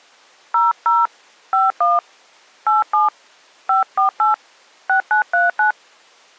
DTMF, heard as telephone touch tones, dialled by hand, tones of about 140 ms. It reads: 00 51 87 548 6939